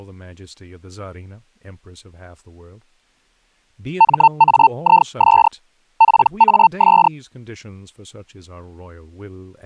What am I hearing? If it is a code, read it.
Hellschreiber (Feld-Hell, 122.5 baud), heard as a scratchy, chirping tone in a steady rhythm, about 900 Hz, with speech in English. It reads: MAIS PAS